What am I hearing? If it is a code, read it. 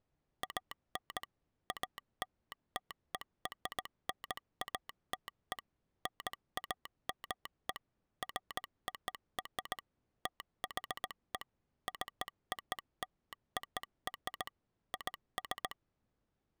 Morse code (American railroad code), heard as a telegraph sounder, machine-sent. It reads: AN ALTERNATE NAME FOR THE COLOR IS